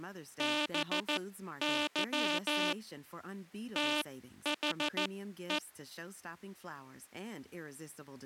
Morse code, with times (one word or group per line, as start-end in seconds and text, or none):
0.4-2.7 BY
3.8-5.6 THE